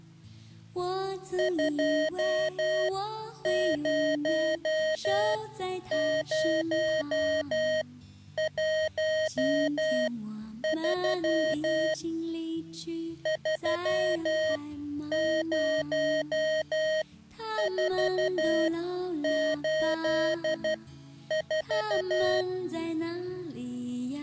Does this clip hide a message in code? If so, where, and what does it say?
Yes: Morse code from 1.3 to 22.5 s, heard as electronic beeps, machine-sent, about 12 wpm, spaced as for 9 wpm, 630 Hz. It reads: 20013 30484